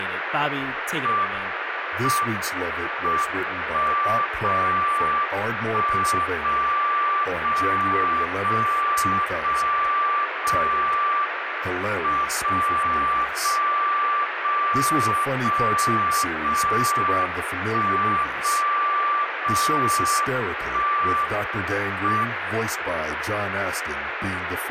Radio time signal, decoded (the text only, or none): M M 1 0 1 0 0 0 0 0 M 0 0 0 0 0 1 0 0 1 M